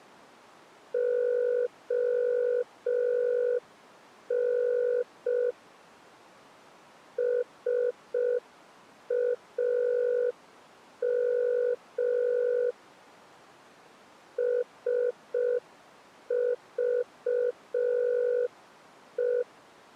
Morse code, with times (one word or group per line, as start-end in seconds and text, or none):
0.9-5.5 ON
7.2-12.7 SAM
14.4-19.4 SVE